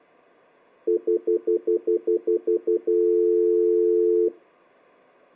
Telephone call progress tone (North American plan), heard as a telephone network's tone, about 350, 440 Hz, 0.1 s on and 0.1 s off. Stutter dial tone.